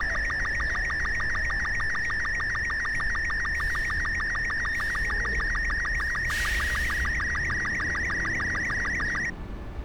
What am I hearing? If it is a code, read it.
SSTV (slow-scan television), Robot 36, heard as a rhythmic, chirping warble, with street noise.